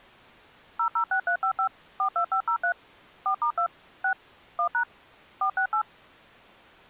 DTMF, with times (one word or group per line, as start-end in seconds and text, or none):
0.8-1.7 006355
2.0-2.7 42503
3.3-3.7 4*2
4.0-4.1 6
4.6-4.8 1#
5.4-5.8 468